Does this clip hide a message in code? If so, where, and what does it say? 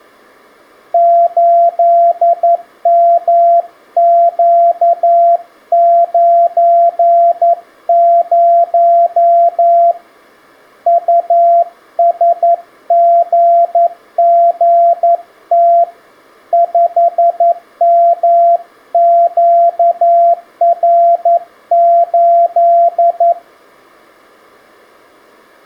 Yes: Morse code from 0.9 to 23.4 s, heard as a keyed tone, hand-sent with a paddle, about 11 wpm, 680 Hz. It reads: 8MQ90 USGGT 5MQR8